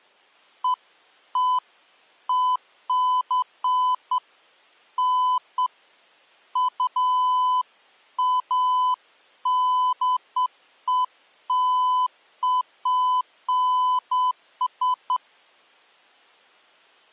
Beeps of irregular length. There is no code.